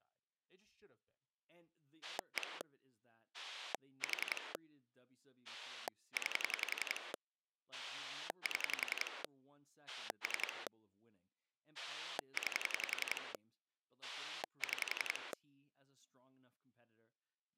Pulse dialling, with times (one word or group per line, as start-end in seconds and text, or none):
2.0-2.6 1
3.3-4.5 4
5.5-7.1 9
7.7-9.2 7
9.9-10.7 3
11.8-13.3 9
14.0-15.3 6